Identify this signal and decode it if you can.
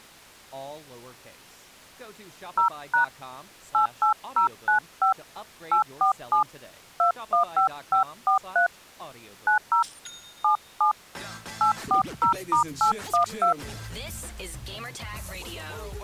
DTMF, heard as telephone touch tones, dialled by hand, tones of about 110 ms. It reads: 0# 88095 847 215543 90 77 840*812